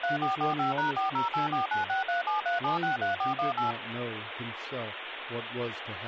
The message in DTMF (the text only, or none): 3445#408496373763418